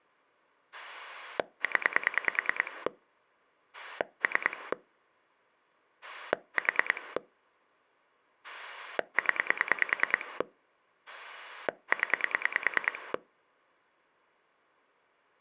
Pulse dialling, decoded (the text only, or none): 0 3 4 0 0